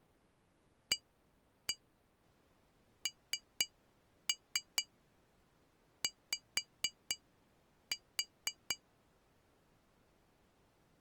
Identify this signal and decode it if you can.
Tap code, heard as taps on glass, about 4 knocks a second. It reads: ANY